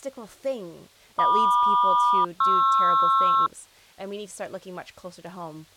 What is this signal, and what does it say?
Aircraft SELCAL, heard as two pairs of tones, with speech in English. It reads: MQ-PR